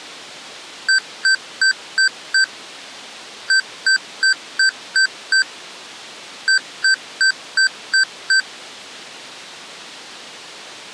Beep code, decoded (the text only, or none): 5-6-6